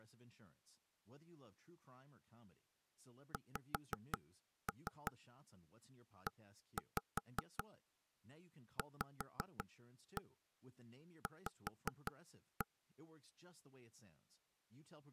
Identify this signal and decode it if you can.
Tap code, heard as knocks on wood, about 5 knocks a second, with speech in English. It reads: XEVV